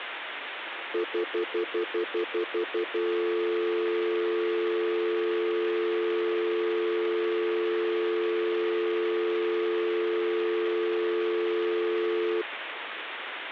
Telephone call progress tone (North American plan), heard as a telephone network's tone, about 350, 440 Hz, 0.1 s on and 0.1 s off, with phone line noise. Stutter dial tone.